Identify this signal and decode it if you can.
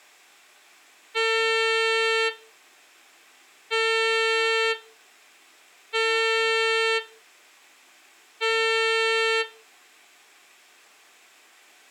Ship horn signal, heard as a ship's horn, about 450 Hz. 4 short. At sea: a pilot vessel's identity signal in fog.